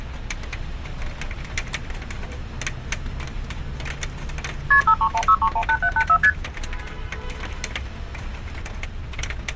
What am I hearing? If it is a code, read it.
Multi-frequency trunk signalling (R1, as on North American trunks), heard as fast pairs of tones, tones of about 70 ms, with street noise. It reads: KP 5316318784 ST